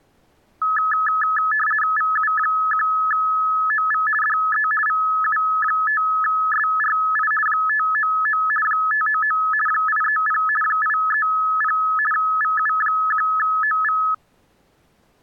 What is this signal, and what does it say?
RTTY (50 baud, 450 Hz shift), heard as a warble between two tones, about 1500 Hz centre. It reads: VU1OV DE VU5SRI 599 599 830 830 VU1OV